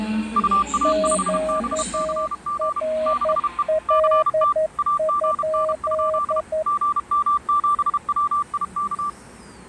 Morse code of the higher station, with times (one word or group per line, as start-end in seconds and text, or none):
0.4-2.8 UA5BCG
3.1-3.6 6E
3.9-4.5 CT
4.8-6.4 AGN?
6.7-9.1 GM7WIK